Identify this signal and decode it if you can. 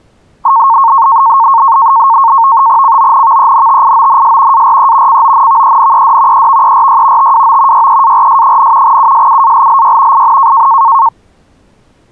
NAVTEX (SITOR-B), 100 baud, 170 Hz shift, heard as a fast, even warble, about 1000 Hz centre. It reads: CONVENTIONS ARE CONVENED EVERY TWO YEARS, USUALLY IN